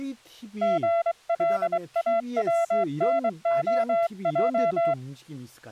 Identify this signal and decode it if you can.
Morse code (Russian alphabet), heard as a keyed tone, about 23 wpm, 680 Hz, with speech in Korean. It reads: ГЛАВНОЙ